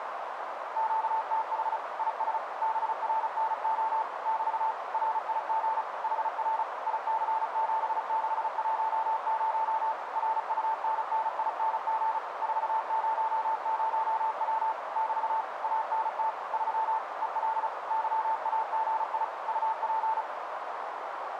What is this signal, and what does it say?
Morse code, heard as a keyed tone, machine-sent, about 35 wpm, 890 Hz, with radio static and a narrow filter. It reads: QTH IS BRNO <BT> RIG HR IC7610 RUNNING 400W <BT> ANT 3 EL YAGI UP